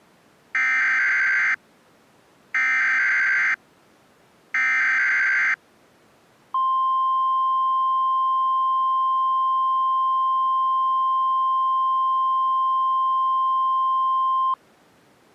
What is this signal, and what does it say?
Emergency Alert System (SAME) tones (header bursts, then the 1050 Hz attention tone), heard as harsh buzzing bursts, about 520.83 baud.